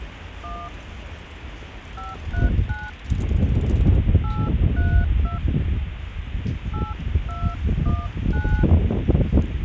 DTMF, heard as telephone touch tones, dialled by hand, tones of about 230 ms, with phone line noise and the noise of a residential street. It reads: 1 539 832 8219